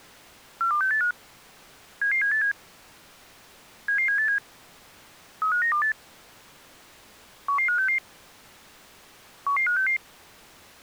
Five-tone selective call (CCIR), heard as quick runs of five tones, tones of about 100 ms. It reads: 42685 77787 77787 35928 11566 11566